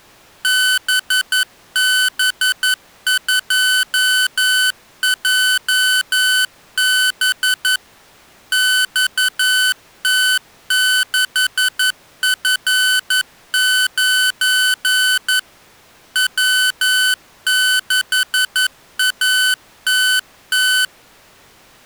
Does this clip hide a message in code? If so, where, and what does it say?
Yes: Morse code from 0.4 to 20.9 s, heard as electronic beeps, machine-sent, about 11 wpm, 1500 Hz. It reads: BB2JB XT6F9 W6ATT